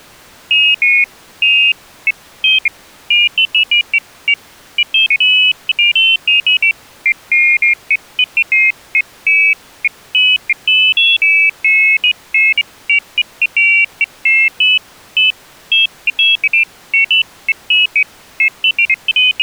Pairs of high tones at irregular times. There is no code.